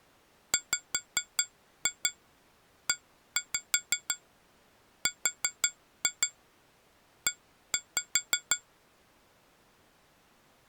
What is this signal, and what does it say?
Tap code, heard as taps on glass, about 5 knocks a second. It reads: WERE